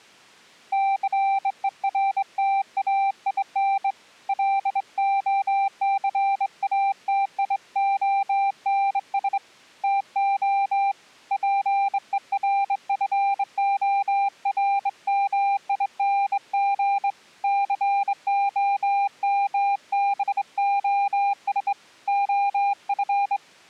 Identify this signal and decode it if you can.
Morse code, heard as a keyed tone, hand-sent with a straight key, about 23 wpm, 790 Hz. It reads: CERTAIN LOCATIONS TO PERFORMING COMBOS OF